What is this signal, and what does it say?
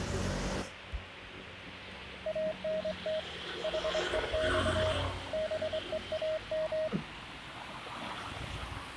Morse code, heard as a keyed tone, hand-sent with a straight key, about 24 wpm, 630 Hz, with street noise. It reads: ANT HEX BEAM